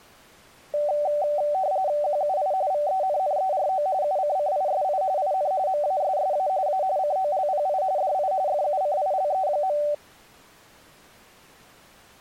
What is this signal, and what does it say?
RTTY (45.45 baud, 170 Hz shift), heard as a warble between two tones, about 680 Hz centre. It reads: QUI VENNERO UCCISI IN MASSA A COLPI DI FUCILE.